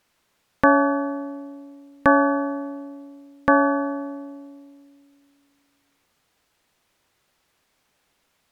Clock strike, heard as a bell. 3. Three o'clock.